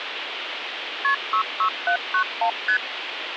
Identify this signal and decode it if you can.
Multi-frequency trunk signalling (R1, as on North American trunks), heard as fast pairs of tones, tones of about 90 ms, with phone line noise. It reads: KP 66791 ST